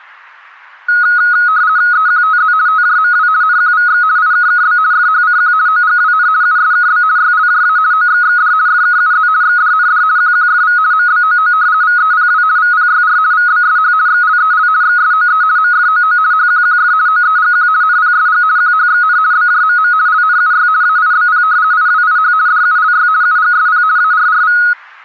RTTY (50 baud, 170 Hz shift), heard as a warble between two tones, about 1360 Hz centre. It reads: EQTZ TJMW NQVX IKKB FHCQ OGWN USKB YLJA OXXD FKUZ XDND QQFV MBOO VEPW VPYR VBSH XLEL XSOE MFOO HQQF OEGQ NPSG QHXN BJMM LNUY AIBP IWIH DULY UGSP ARRV